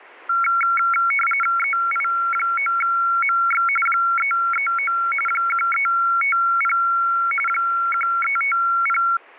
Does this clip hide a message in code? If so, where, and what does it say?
Yes: RTTY (45.45 baud, 850 Hz shift) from 0.3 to 9.2 s, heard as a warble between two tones, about 1800 Hz centre. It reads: EI9MX 339 1350 1350